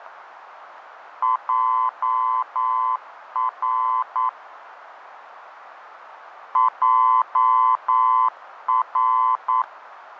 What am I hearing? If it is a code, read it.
Morse code, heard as a keyed tone, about 9 wpm, 1020 Hz, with radio static. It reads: JR JR